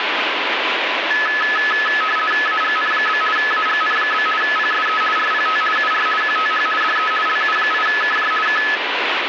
RTTY (50 baud, 450 Hz shift), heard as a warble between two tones, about 1500 Hz centre, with radio static. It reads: AGN? AGN? PSE RPT UR QTH DE LU8KJ K